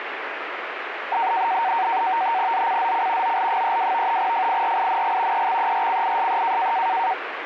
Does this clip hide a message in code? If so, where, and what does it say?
Yes: NAVTEX (SITOR-B), 100 baud, 170 Hz shift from 1.1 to 7.1 s, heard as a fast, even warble, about 840 Hz centre, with radio static. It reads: ZCZC OL32 FIRING EXERCISE